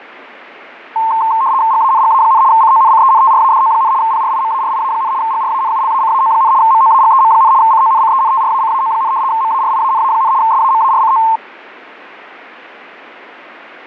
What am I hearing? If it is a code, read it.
RTTY (75 baud, 170 Hz shift), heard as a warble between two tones, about 980 Hz centre. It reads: GANGA, CONCENTRADO, PRIMARIA, GRANULACAO, MOAGEM, CONCENTRACAO, MARIANA, SAMARCO